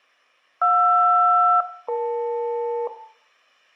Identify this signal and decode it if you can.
Aircraft SELCAL, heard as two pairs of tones, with room echo. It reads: JR-EL